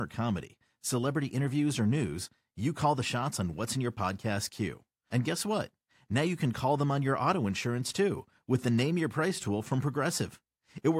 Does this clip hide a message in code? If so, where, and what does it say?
No, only speech in English.